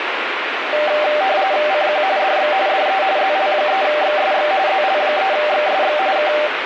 RTTY (45.45 baud, 170 Hz shift), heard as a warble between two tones, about 690 Hz centre, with radio static. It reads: CQ DX DE ZL3XSX ZL3XSX K